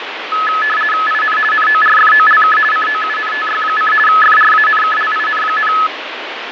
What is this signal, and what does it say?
RTTY (50 baud, 450 Hz shift), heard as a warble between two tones, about 1500 Hz centre, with radio static and fading. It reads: IN NORFOLK COUNTY: FRANKLIN,